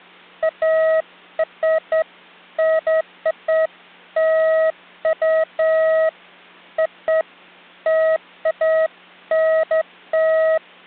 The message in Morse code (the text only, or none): none